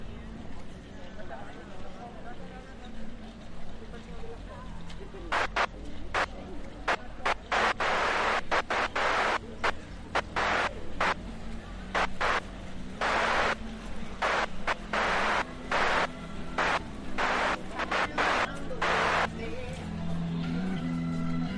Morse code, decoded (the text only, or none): none